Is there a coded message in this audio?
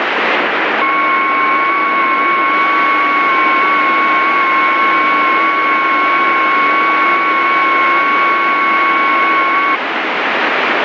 Yes: FT8 (several signals at once) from 0.8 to 9.8 s, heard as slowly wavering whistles, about 6.25 baud, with heavy radio static.